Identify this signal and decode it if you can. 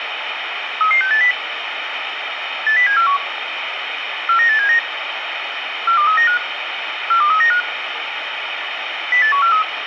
Five-tone selective call (CCIR), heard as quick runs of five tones, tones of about 100 ms, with radio hiss. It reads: 33680 80741 49879 42395 42395 08143